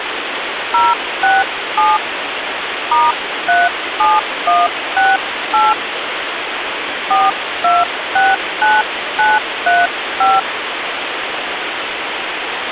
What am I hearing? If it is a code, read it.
DTMF, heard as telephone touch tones, dialled by hand, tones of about 200 ms, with phone line noise. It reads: 067 *37168 4269935